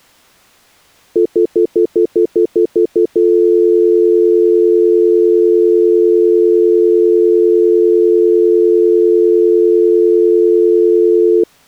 Telephone call progress tone (North American plan), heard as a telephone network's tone, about 350, 440 Hz, 0.1 s on and 0.1 s off. Stutter dial tone.